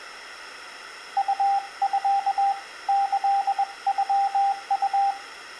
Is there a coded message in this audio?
Yes: Morse code (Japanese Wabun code) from 1.1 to 5.2 s, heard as a keyed tone, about 21 wpm, 790 Hz, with room echo. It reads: ウミ キノウ